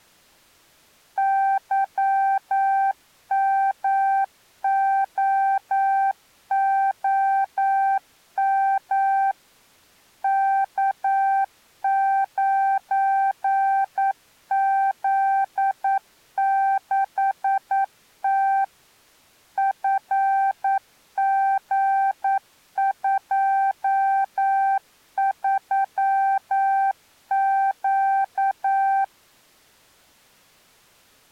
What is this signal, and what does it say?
Morse code, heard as a keyed tone, machine-sent, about 9 wpm, 780 Hz. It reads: YMOOM K9Z6T FG23Q